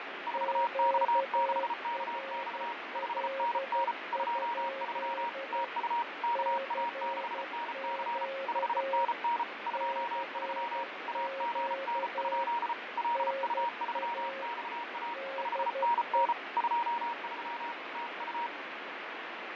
Morse code, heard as two keyed tones, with heavy radio static and fading. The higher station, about 34 wpm, 940 Hz: 4X6KX 5NN 23 TU KA6NC 5NN 23 AGN? LU3XA 5NN 23 TU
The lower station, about 12 wpm, 540 Hz: QRL? CQ CQ NA DE